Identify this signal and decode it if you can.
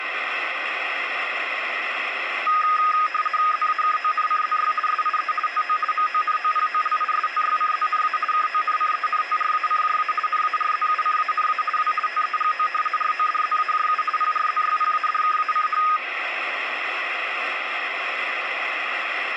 RTTY (50 baud, 450 Hz shift), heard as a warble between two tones, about 1470 Hz centre, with radio static. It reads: ZAKONCZY SIE TO MONOPOLISTYCZNA KONCENTRACJA NARZUCANA W TEGO RODZAJU PRZYPADKACH